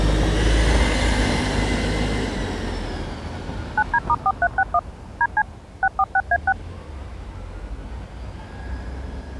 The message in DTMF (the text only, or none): 9D*4361 DC 646A6